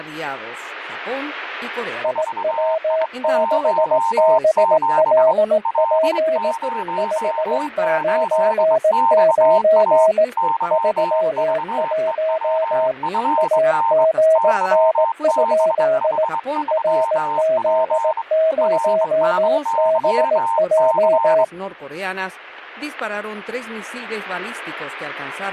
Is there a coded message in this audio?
Yes: Morse code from 2.0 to 21.5 s, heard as two keyed tones, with static crashes and speech in Spanish. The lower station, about 18 wpm, 640 Hz: IW6BLP 599 31 AGN? RZ0BJ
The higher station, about 23 wpm, 910 Hz: 4I17 L08XA YVEWFN YBH3P RSYC